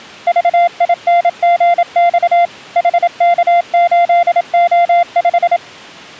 Morse code, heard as a keyed tone, machine-sent, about 27 wpm, 690 Hz. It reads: VINGX HK8O5